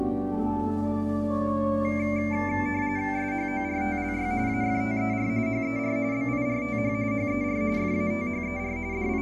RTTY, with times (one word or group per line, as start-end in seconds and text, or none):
3.2-4.3 SHORTLY
4.5-5.3 AFTER
5.5-6.0 HER
6.1-6.9 BIRTH
7.1-7.6 HER
7.8-8.8 FATHER
8.9-9.2 …